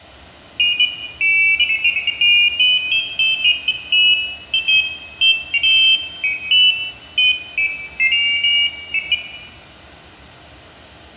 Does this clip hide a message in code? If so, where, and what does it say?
No, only pairs of high tones at irregular times, with room echo.